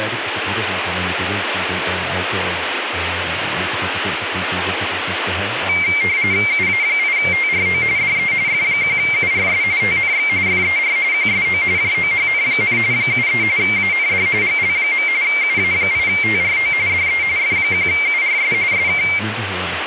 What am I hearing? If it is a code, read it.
RTTY (45.45 baud, 170 Hz shift), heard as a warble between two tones, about 2200 Hz centre, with radio static and speech in Danish. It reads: UA8TRO DE F1URS TNX FER QSO JOHN, 73 AND GL. UA8TRO DE F1URS SK